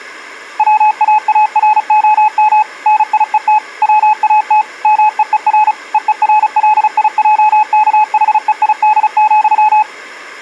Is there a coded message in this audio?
Yes: Morse code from 0.5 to 9.9 s, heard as a keyed tone, machine-sent, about 35 wpm, 850 Hz. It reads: WAAROM NIET WAT MEER EERLIJKHEID,